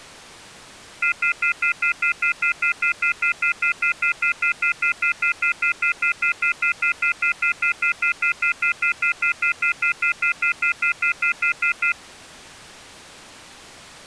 Telephone call progress tone (North American plan), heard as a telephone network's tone, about 1400, 2050, 2450, 2600 Hz, 0.1 s on and 0.1 s off. Off-hook warning tone.